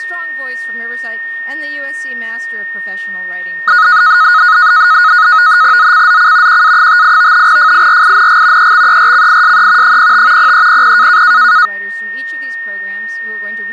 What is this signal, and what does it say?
NAVTEX (SITOR-B), 100 baud, 170 Hz shift, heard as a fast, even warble, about 1360 Hz centre, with a steady whistle near 1840 Hz. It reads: ZCZC QA58 FIRING EXERCISE 05 0300